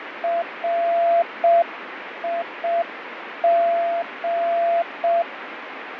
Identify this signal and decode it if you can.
Morse code, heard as a keyed tone, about 6 wpm, 680 Hz, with radio static and fading. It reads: RIG